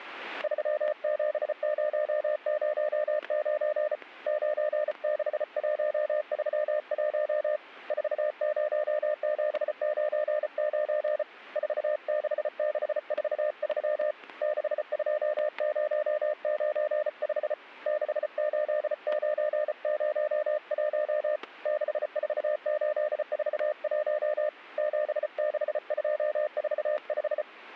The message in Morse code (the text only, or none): 37009 96131 40799 46643 62095 68901 64841 76245